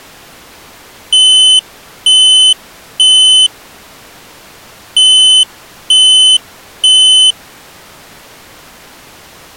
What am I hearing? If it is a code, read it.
Alarm pattern, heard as an alarm's beeps, played twice, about 3050 Hz. Temporal three. Smoke or fire, evacuate.